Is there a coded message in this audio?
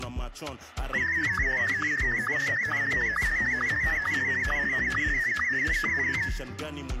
Yes: SSTV (slow-scan television), Martin M1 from 0.9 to 6.3 s, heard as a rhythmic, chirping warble, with room echo.